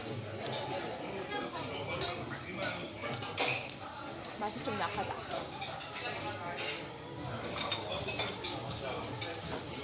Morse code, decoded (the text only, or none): none